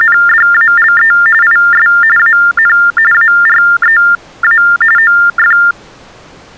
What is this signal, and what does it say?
TTY/TDD text telephone tones (45.45 baud Baudot), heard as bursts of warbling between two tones, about 400 Hz shift, 1600 Hz centre. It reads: … IS AN AREA OF